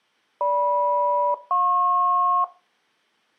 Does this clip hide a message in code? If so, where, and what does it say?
Yes: aircraft SELCAL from 0.4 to 2.4 s, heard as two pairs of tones. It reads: GM-JP